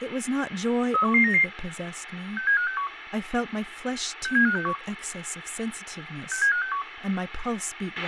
Five-tone selective call (CCIR), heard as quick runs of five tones, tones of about 100 ms, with radio hiss, a squelch burst at the end and speech in English. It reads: 31199 67561 67561 67561